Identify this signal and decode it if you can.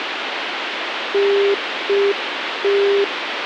Telephone call progress tone (UK plan), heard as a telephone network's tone, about 400 Hz, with phone line noise. Congestion tone.